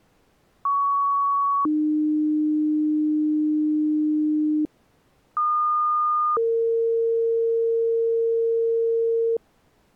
Two-tone page, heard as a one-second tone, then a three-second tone, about 1120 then 300 Hz, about 1220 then 460 Hz.